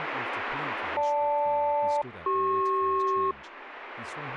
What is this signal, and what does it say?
Aircraft SELCAL, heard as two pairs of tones, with radio static and speech in English. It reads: GL-CP